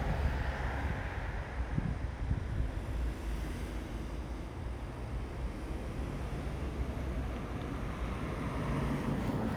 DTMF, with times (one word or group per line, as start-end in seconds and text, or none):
none